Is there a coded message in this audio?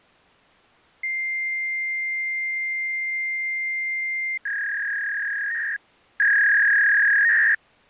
Yes: fax machine handshake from 1.0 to 7.5 s, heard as a long tone and a warble.